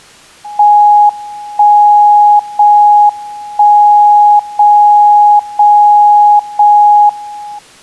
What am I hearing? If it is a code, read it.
Radio time signal (JJY), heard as a tone whose level steps once a second, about 830 Hz. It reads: 1 0 1 0 0 0 1